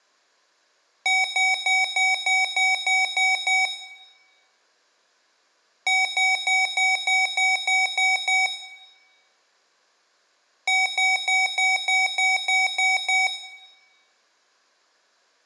Beep code, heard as beeps from a small speaker, played three times, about 760 Hz, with room echo. 9 short. In AMI BIOS tables: ROM checksum failure.